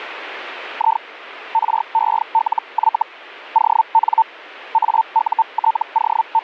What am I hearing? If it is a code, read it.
Hellschreiber (Feld-Hell, 122.5 baud), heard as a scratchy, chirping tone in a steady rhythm, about 900 Hz. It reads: I RELY ON …